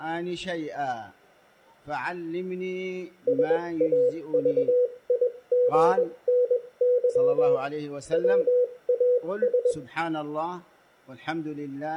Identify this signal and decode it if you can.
Morse code, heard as a keyed tone, machine-sent, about 21 wpm, spaced as for 18 wpm, 490 Hz. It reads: SAVIGNY WAS